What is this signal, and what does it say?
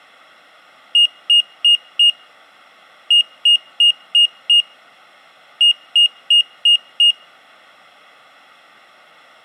Beep code, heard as a piezo beeper, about 2850 Hz. 4-5-5.